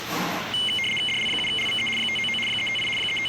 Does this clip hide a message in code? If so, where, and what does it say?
Yes: RTTY (75 baud, 850 Hz shift) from 0.5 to 3.3 s, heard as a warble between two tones, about 2550 Hz centre, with radio static and the noise of a cafe. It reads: DL7LVE 599 358 …